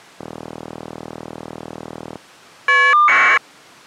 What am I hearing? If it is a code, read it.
Caller ID data burst, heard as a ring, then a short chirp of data, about 1200 baud.